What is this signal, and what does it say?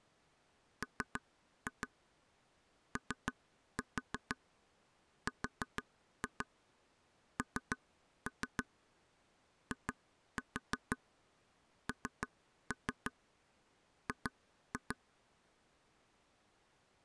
Tap code, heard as taps on a table, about 6 knocks a second. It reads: MORNING